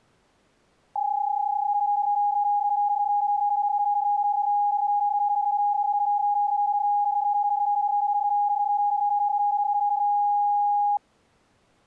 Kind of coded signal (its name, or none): PSK31